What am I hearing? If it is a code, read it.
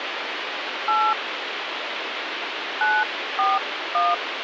DTMF, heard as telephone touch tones, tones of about 200 ms, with phone line noise. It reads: 8 941